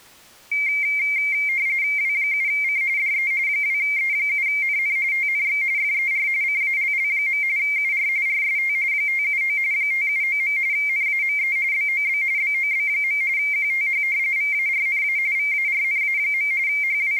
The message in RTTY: W7C DE 2E7NN TNX FER CALL. UR RST 579 579. NAME BOB BOB. QTH VARNA VARNA. …

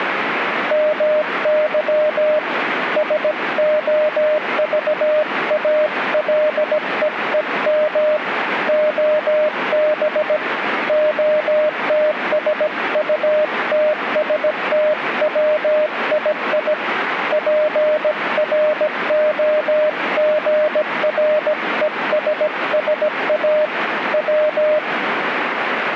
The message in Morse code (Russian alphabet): МЫ СОЖАЛЕЕМ ОБ ОТСУТСТВИИ ПРОГРЕССА В

